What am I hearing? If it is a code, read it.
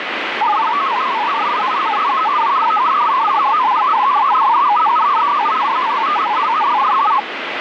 Multi-tone FSK (Olivia or MFSK type), about 500 Hz wide, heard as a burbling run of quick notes, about 62.5 baud, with radio static.